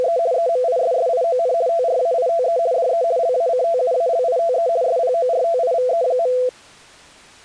RTTY (50 baud, 170 Hz shift), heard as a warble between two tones, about 590 Hz centre. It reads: … EMISSION TRAITE DE LACTUALITE SPORTIVE.